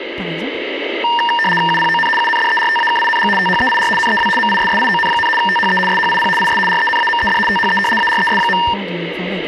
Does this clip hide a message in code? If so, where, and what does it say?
Yes: RTTY (75 baud, 850 Hz shift) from 1.0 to 8.7 s, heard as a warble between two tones, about 1370 Hz centre, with speech in French. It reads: UPON UNDERTAKING THEIR NEW MISSION, THE SHIP IS RENAMED THE ARES.